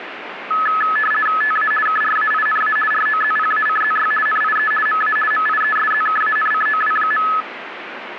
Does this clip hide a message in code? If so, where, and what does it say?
Yes: RTTY (50 baud, 450 Hz shift) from 0.5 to 7.4 s, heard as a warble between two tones, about 1500 Hz centre, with radio static. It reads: TA KRAINA ROZPACZY NIE MA MIESZKANCOW.